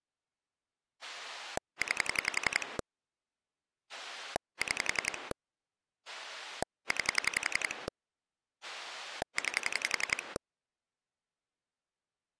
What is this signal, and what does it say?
Pulse dialling, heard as a rotary dial, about 11 pulses a second. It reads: 9 6 9 9